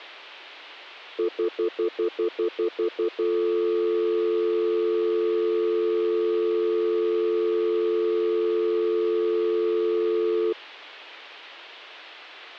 Telephone call progress tone (North American plan), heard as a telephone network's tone, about 350, 440 Hz, 0.1 s on and 0.1 s off. Stutter dial tone.